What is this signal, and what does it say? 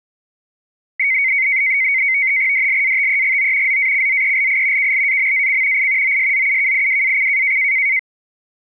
NAVTEX (SITOR-B), 100 baud, 170 Hz shift, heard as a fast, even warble, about 2150 Hz centre. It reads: DLATEGO ZACZELI KLAMAC I OSZUKIWAC